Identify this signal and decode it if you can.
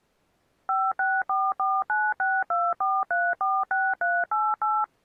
DTMF, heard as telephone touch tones, dialled by machine, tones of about 230 ms. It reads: 56449624346388